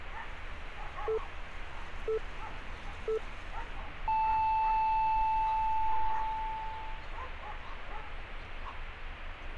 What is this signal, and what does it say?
Radio time signal (three low pips and a long one an octave up, as on NHK), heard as pips, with street noise.